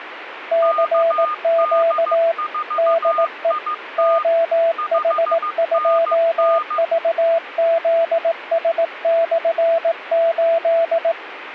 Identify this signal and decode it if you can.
Morse code, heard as two keyed tones, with radio static. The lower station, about 18 wpm, 660 Hz: CQ DE OH2VZS/8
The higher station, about 15 wpm, 1220 Hz: KD4IT 5NN